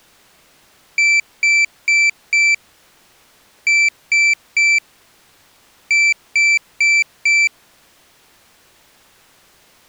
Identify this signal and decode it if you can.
Beep code, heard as a piezo beeper, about 2350 Hz. 4-3-4. In Phoenix BIOS tables: time-of-day clock failure.